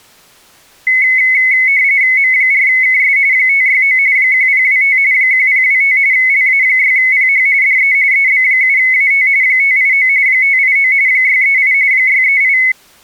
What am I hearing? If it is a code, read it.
RTTY (45.45 baud, 170 Hz shift), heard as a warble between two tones, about 2100 Hz centre. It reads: M4KS 569 1025 1025 LA6PH DE EB7AT 589 589 638 638